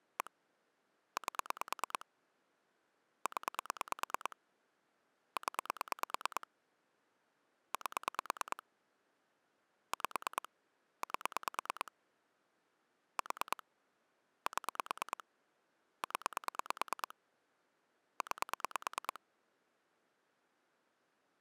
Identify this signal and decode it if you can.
Pulse dialling, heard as clicks on a phone line, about 9 pulses a second. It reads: 1 8 0 0 8 5 8 4 7 0 9